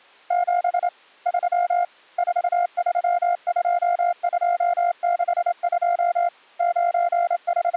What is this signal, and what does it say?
Morse code, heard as a keyed tone, hand-sent with a straight key, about 28 wpm, 700 Hz. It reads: 7 3 432262 …